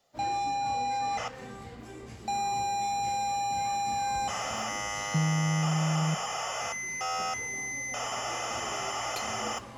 ZX Spectrum tape loading, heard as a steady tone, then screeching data, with the noise of a cafe.